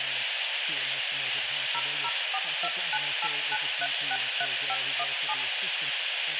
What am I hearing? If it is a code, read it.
DTMF, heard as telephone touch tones, dialled by machine, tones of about 50 ms, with radio hiss, a squelch burst at the end, room echo and speech in English. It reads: 0042989363517